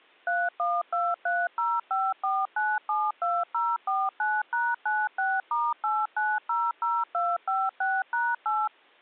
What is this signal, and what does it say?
DTMF, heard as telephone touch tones, dialled by machine, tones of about 220 ms. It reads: 3123054972049#96*8900256#8